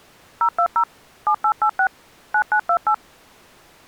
DTMF, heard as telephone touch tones, dialled by machine, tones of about 80 ms. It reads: 020 7886 9928